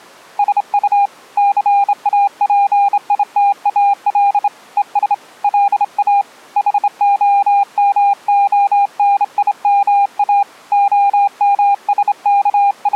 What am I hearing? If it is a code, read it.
Morse code, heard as a keyed tone, hand-sent with a straight key, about 27 wpm, 800 Hz. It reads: SU CAPITAL ES LA HOMONIMA …